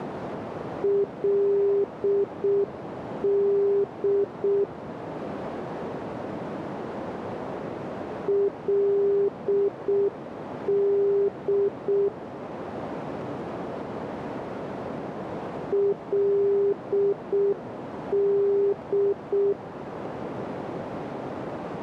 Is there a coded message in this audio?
Yes: Morse code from 0.8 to 19.6 s, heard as a keyed tone, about 6 wpm, 400 Hz, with radio static and a narrow filter. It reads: LD LD LD